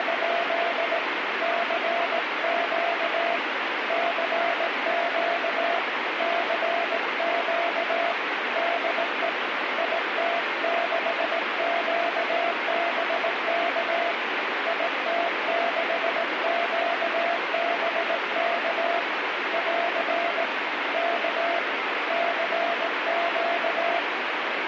Morse code, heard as a keyed tone, hand-sent with a paddle, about 18 wpm, 680 Hz, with heavy radio static. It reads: … CQ CQ CQ DE IT6QBK IT6QBK <AR> K CQ